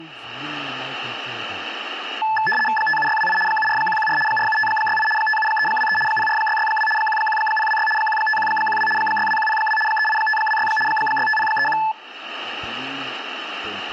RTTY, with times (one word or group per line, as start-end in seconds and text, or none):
2.8-3.4 57628
3.5-4.2 74114
4.3-5.1 47568
5.2-6.0 57323
6.1-6.9 04662
7.0-7.9 11026
8.0-8.9 15112
9.0-9.8 62102
9.9-10.7 38526
10.9-11.8 65031